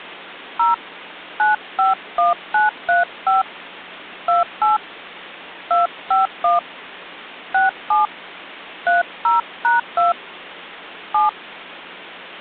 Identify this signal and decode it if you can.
DTMF, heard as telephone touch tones, dialled by hand, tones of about 150 ms. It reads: 0 951935 28 251 67 30#2 7